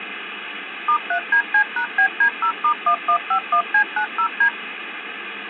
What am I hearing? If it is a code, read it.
DTMF, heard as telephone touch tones, dialled by machine, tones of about 80 ms, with phone line noise. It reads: *3DC#BD0*1151C90D